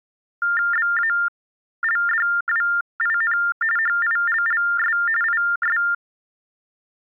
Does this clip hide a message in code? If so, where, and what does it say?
Yes: TTY/TDD text telephone tones (45.45 baud Baudot) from 0.4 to 5.9 s, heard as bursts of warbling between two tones, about 400 Hz shift, 1600 Hz centre. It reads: BALDWIN HILLS IS